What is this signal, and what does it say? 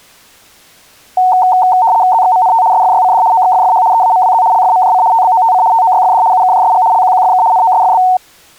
RTTY (75 baud, 170 Hz shift), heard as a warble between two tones, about 820 Hz centre. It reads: ZXMNT SFYCD OXFFH EAMWZ LFMJC TBOTC TOYFD UKJSG LQQFK NOSFB